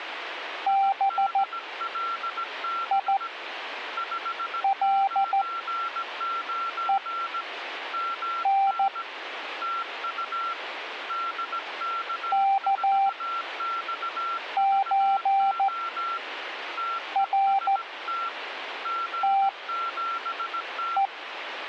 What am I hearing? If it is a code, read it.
Morse code (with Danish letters), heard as a keyed tone, machine-sent, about 14 wpm, spaced as for 5 wpm, 780 Hz, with a weaker station near 1360 Hz. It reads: BILEN KØRTE